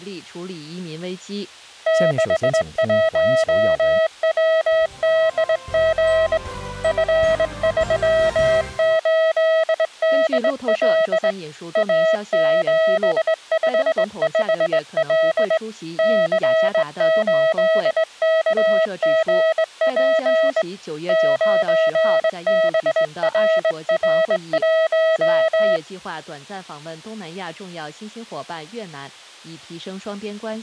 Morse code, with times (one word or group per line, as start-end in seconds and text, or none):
1.9-6.4 61WDG
6.8-11.3 F38DL
11.8-15.6 A755L
16.0-20.6 C8KGP
21.1-25.8 9BRR1